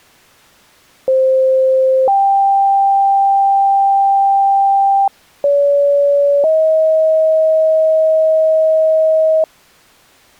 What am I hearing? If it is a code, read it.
Two-tone page, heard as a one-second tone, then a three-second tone, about 520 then 790 Hz, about 570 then 630 Hz.